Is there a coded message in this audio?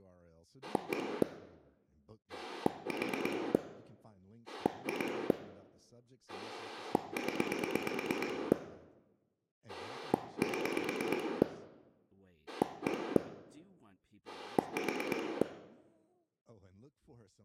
Yes: pulse dialling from 0.6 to 15.4 s, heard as a rotary dial, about 8 pulses a second, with room echo and speech in English. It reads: 1 4 2 0 7 1 4